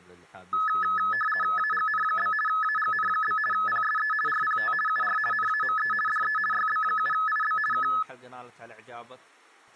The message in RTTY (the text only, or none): AGN? AGN? PSE RPT UR NAME DE YB7IB K